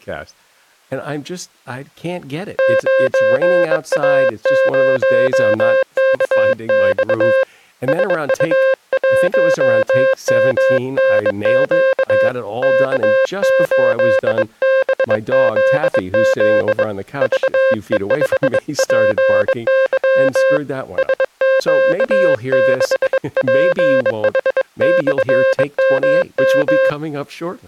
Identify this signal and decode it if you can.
Morse code, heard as a keyed tone, hand-sent with a bug key, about 22 wpm, 530 Hz, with speech in English. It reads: 9A0KX SU1MNQ K8BZZ VE5PY SQ6PH/MM